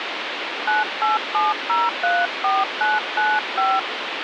DTMF, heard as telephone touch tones, dialled by hand, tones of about 190 ms, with phone line noise. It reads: 987034995